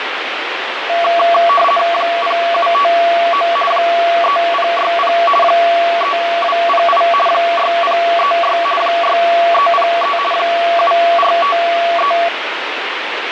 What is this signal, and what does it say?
RTTY (50 baud, 450 Hz shift), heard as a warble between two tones, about 910 Hz centre, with radio static. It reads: 0759 3060 3208 6036 6303 7453